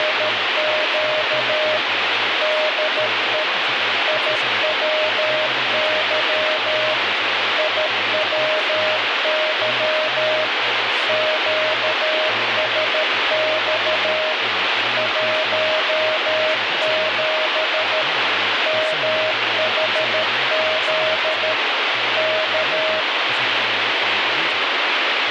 Morse code, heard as a keyed tone, machine-sent, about 13 wpm, 620 Hz, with heavy radio static and speech in English. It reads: … DE IWY IWY QSX 17 MHZ K